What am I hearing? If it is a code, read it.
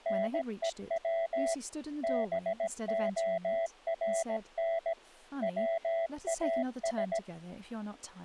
Morse code, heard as a keyed tone, machine-sent, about 17 wpm, 660 Hz, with speech in English. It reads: NEW BORN WAS